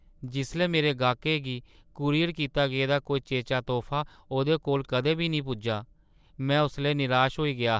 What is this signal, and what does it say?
Speech in Dogri. There is no code.